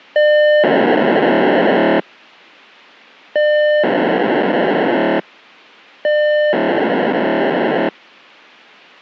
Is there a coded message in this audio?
Yes: POCSAG pager data (1200 baud) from 0.2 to 7.9 s, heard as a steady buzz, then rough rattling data.